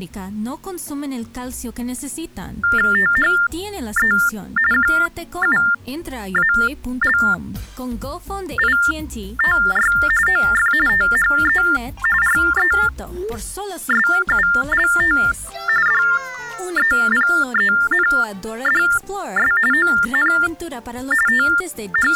TTY/TDD text telephone tones (45.45 baud Baudot), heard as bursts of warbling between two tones, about 400 Hz shift, 1600 Hz centre. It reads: THE QUALITY OF THE RESULT DEPENDS ON …